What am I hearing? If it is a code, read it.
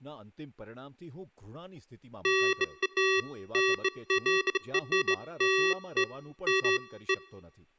Beeps of irregular length, with speech in Gujarati. There is no code.